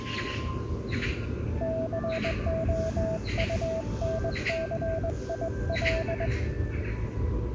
Morse code, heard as a keyed tone, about 20 wpm, 650 Hz, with the noise of a park. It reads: COUNCIL